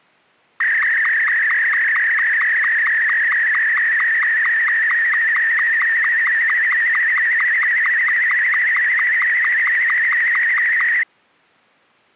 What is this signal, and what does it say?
SSTV (slow-scan television), Martin M2, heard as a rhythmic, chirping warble.